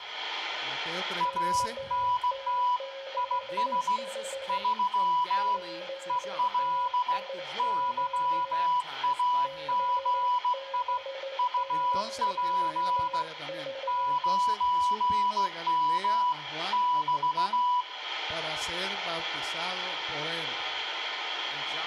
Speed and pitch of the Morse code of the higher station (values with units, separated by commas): 16 wpm, 990 Hz